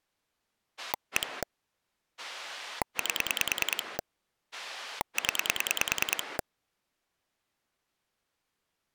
Pulse dialling, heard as a rotary dial, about 10 pulses a second. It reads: 1 8 0